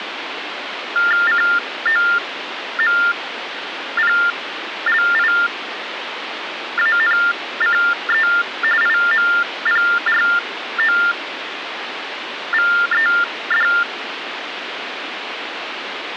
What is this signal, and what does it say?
TTY/TDD text telephone tones (45.45 baud Baudot), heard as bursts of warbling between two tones, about 400 Hz shift, 1600 Hz centre, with phone line noise. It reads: COMPLIANCE IMPROVED